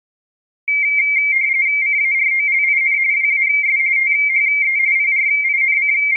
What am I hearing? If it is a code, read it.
RTTY (45.45 baud, 170 Hz shift), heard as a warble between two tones, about 2200 Hz centre. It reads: CAROLIN WAS THE …